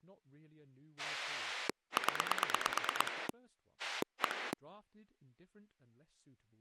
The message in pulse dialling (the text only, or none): 0 1